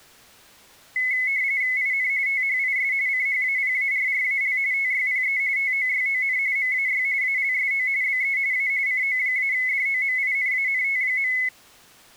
RTTY (45.45 baud, 170 Hz shift), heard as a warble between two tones, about 2100 Hz centre. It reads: IN THIS CHAPARRAL TYPE TOYON MAY ALSO BE A CO-DOMINANT.